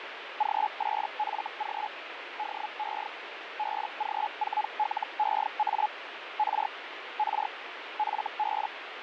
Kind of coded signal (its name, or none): Hellschreiber